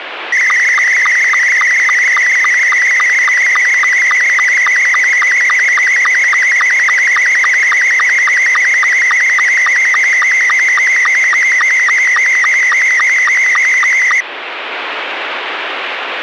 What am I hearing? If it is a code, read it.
SSTV (slow-scan television), Scottie S2, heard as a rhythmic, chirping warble, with radio static.